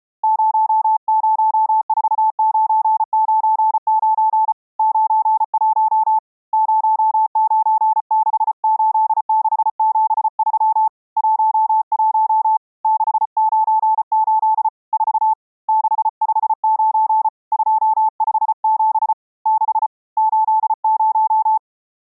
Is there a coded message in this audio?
Yes: Morse code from 0.2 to 21.6 s, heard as a keyed tone, hand-sent with a paddle, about 34 wpm, 870 Hz. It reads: 004999 91 0968673 11 698 4 659 257 6 80